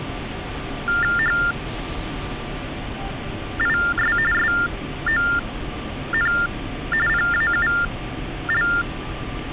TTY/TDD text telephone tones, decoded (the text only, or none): HIS SON PAUL